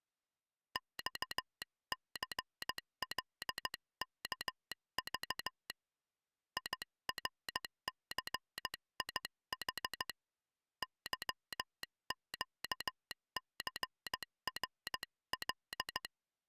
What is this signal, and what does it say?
Morse code, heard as a telegraph sounder, hand-sent with a paddle, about 15 wpm. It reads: XCLKV IRCIH YQCRL